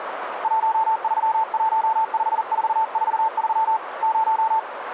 Morse code, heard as a keyed tone, hand-sent with a paddle, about 40 wpm, 890 Hz, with radio static and a narrow filter. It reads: 1315443 0